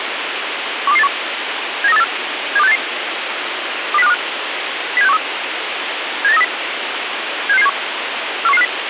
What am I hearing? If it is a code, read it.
Five-tone selective call (EEA), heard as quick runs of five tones, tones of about 40 ms, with radio hiss. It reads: 12281 79384 72688 20525 07613 78930 76671 41150